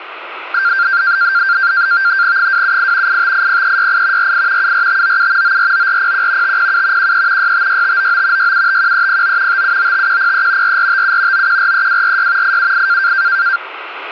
NAVTEX (SITOR-B), 100 baud, 170 Hz shift, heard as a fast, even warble, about 1480 Hz centre, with radio static. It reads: 278 8580368 48 74597 949401 507 13 656599 6751309 5795103 4457 9143246 878